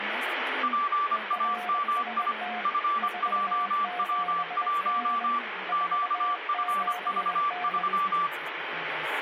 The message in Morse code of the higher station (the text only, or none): PAMI FJW1 QFV3